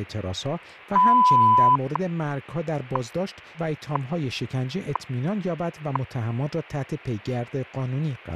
Radio time signal (WWV, Colorado), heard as ticks, one a second, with speech in Persian.